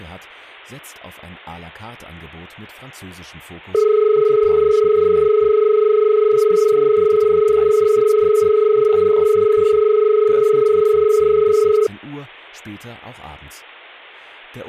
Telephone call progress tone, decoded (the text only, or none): dial tone